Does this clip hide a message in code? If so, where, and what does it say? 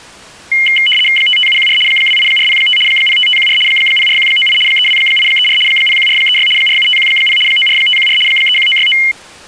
Yes: RTTY (75 baud, 850 Hz shift) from 0.5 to 9.1 s, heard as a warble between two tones, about 2550 Hz centre. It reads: 55714 28405 05514 04198 32834 01436 47510 94514 31969